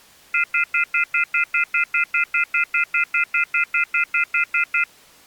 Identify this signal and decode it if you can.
Telephone call progress tone (North American plan), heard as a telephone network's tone, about 1400, 2050, 2450, 2600 Hz, 0.1 s on and 0.1 s off. Off-hook warning tone.